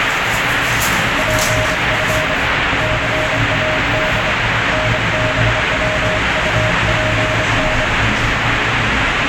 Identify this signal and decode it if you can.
Morse code (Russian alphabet), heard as a keyed tone, hand-sent with a straight key, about 25 wpm, 620 Hz, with heavy radio static and the noise inside a lift. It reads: ПФ ЦАД НБВУПН